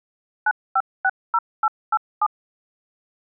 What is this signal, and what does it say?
DTMF, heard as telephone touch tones, dialled by machine, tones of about 50 ms. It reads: 9560887